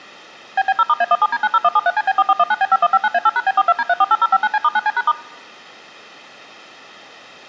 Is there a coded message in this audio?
Yes: DTMF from 0.6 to 5.1 s, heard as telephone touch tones, dialled by machine, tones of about 40 ms. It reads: BB0*A17D90173CB4419B5159A8#B42D348059C*9C#*